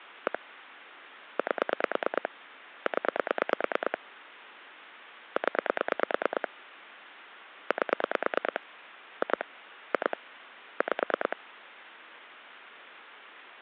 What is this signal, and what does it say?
Pulse dialling, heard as clicks on a phone line, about 9 pulses a second, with phone line noise. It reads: 1 8 0 0 8 2 2 5